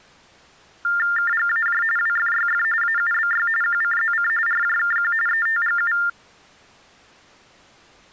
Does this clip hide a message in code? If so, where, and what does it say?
Yes: TTY/TDD text telephone tones (45.45 baud Baudot) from 0.8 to 6.1 s, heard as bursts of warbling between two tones, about 400 Hz shift, 1600 Hz centre. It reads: KGAJ WFYF AUBY QCZC RJKQ ETGU